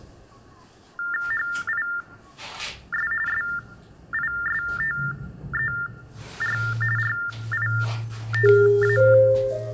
TTY/TDD text telephone tones (45.45 baud Baudot), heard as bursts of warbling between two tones, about 400 Hz shift, 1600 Hz centre, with the noise inside a lift. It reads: HIS SISTER RITA